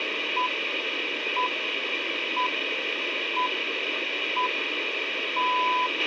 Radio time signal (six pips, as the Greenwich Time Signal), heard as pips, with radio hiss and a squelch burst at the end.